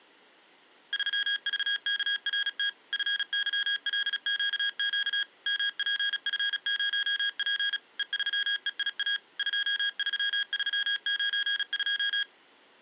Morse code, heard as electronic beeps, machine-sent, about 36 wpm, 1650 Hz. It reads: 3VKRT FYLQQ MPF0P E3EIA 23392